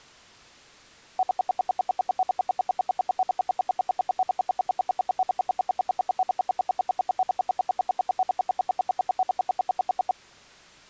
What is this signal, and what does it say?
Radio time signal (RWM, Moscow), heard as ten pulses a second.